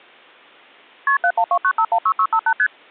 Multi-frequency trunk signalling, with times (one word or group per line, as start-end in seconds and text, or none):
1.1-1.2 KP
1.2-2.5 7129516658
2.6-2.7 ST